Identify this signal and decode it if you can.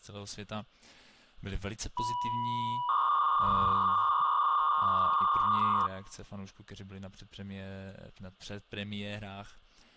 300-baud modem data (V.21 tones), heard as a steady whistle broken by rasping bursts, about 300 baud, 200 Hz shift.